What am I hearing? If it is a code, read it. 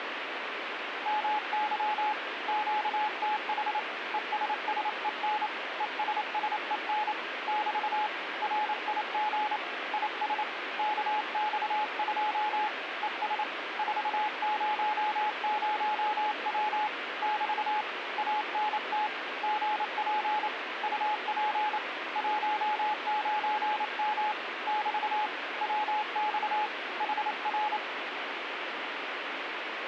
Morse code, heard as a keyed tone, hand-sent with a paddle, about 28 wpm, 850 Hz, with radio static. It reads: MY QTH ESSEN ESSEN <BT> RIG IS KX2 ES 400W <BT> ANT GP UP 19M <BT> WX HR